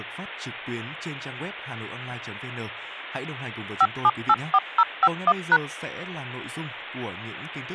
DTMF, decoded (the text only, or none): 5784051#